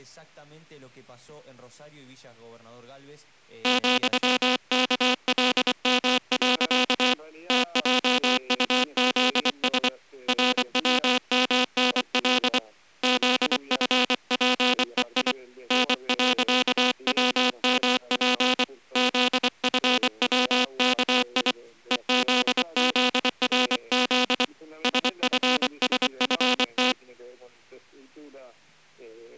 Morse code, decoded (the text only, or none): ,KLM. TJUZS RWMNL ZFPEI N.WMP ZFWKI EZZRZ SFSFT